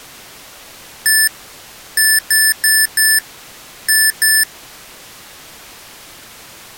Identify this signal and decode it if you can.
Beep code, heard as beeps from a small speaker, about 1750 Hz. 1-4-2. In Phoenix BIOS tables: parity failure in the first 64 KB of memory.